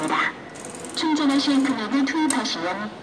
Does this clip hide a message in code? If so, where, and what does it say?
No, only the noise of a subway station.